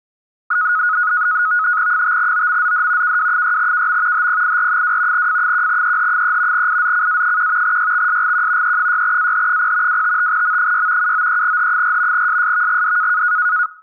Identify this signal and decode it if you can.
NAVTEX (SITOR-B), 100 baud, 170 Hz shift, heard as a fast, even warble, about 1360 Hz centre. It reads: 5OMZD KW6KM HPIR2 F1EH3 IZCA1 YXSGQ E6AH0 255M6 793H4 SSVGD